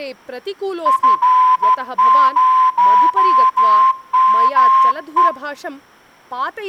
Morse code, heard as a whistle, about 13 wpm, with speech in Sanskrit. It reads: F0ME